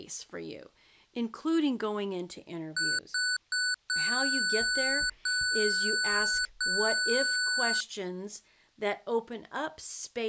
Beep code, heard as beeps from a small speaker, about 1490 Hz, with speech in English. 3 short, 3 long.